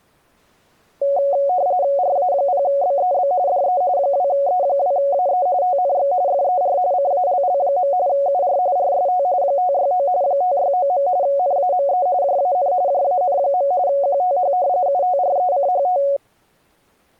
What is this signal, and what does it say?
RTTY (45.45 baud, 170 Hz shift), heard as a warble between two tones, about 640 Hz centre. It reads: RA0BEB DE 2E2AE TNX FER CALL. UR RST 569 569. NAME JAN JAN. QTH UTRECHT